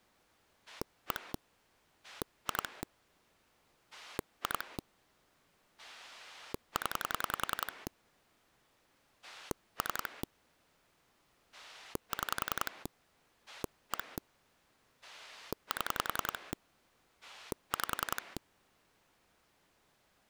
Pulse dialling, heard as a rotary dial, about 10 pulses a second. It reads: 1 2 2 0 3 6 1 7 5